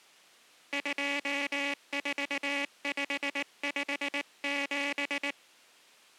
Morse code, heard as a buzzer, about 19 wpm. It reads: 24557